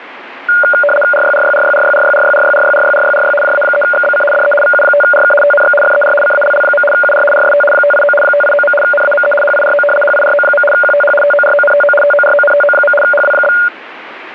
RTTY (75 baud, 850 Hz shift), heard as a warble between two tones, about 1000 Hz centre, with radio static. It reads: RYRYRYRYRYRYRYRYRYRYRY JA3XBC DE VU5RK TNX FER CALL. UR RST 589 589. NAME HIRO HIRO. QTH TORONTO TORONTO. HW?